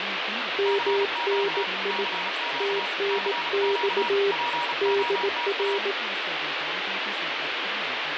Morse code, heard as two keyed tones, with radio static and speech in English. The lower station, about 18 wpm, 400 Hz: MNI TNX DR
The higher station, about 35 wpm, 950 Hz: CQ CQ CQ POTA